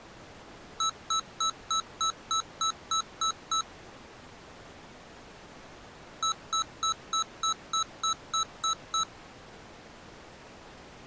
Beep code, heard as beeps from a small speaker, played twice, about 1300 Hz. 10 short. In AMI BIOS tables: CMOS shutdown register error.